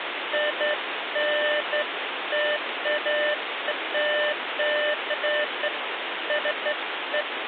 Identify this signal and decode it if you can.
Beeps of irregular length, with phone line noise. There is no code.